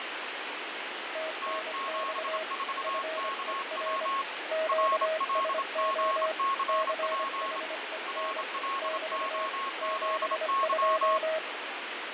Morse code, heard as two keyed tones, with heavy radio static and fading. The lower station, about 25 wpm, 640 Hz: TNX FER QSO CHEN <BT> 72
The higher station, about 27 wpm, 1090 Hz: T74KW RLGCP RLOZY